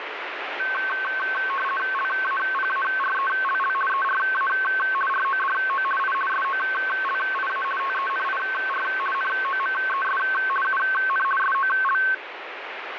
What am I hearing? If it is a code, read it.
RTTY (50 baud, 450 Hz shift), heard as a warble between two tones, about 1320 Hz centre, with radio static. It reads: LAPARELL ERA RODO I SOLIA TENIR NOMES UN SOL